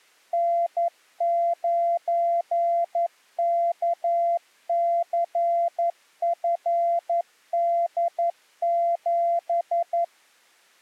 Morse code, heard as a keyed tone, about 11 wpm, 680 Hz. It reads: N9KCFD7